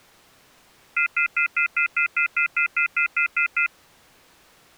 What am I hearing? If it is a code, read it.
Telephone call progress tone (North American plan), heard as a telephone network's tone, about 1400, 2050, 2450, 2600 Hz, 0.1 s on and 0.1 s off. Off-hook warning tone.